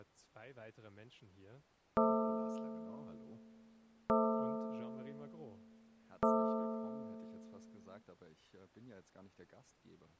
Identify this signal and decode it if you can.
Clock strike, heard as a bell, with speech in German. 3. Three o'clock.